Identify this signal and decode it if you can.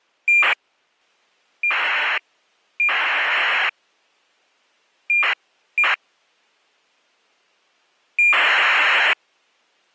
ACARS aircraft data, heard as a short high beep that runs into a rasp, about 2400 baud.